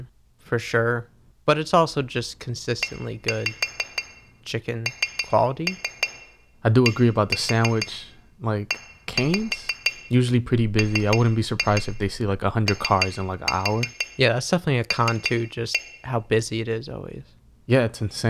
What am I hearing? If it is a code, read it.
Tap code, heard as taps on glass, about 6 knocks a second, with room echo and speech in English. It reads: ENDEMOL